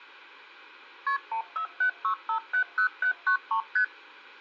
Multi-frequency trunk signalling (R1, as on North American trunks), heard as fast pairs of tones, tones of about 100 ms. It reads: KP 1476570793 ST